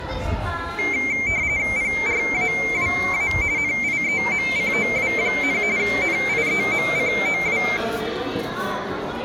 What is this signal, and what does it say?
RTTY (45.45 baud, 170 Hz shift), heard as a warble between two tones, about 2200 Hz centre, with the noise of a crowd indoors. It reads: PRAWA NIEMCOW, NIEMCOW